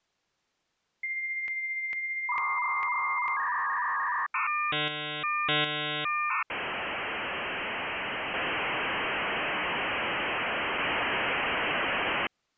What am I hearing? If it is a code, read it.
Dial-up modem handshake (V.34 or later), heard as a whistle, warbles, then hiss.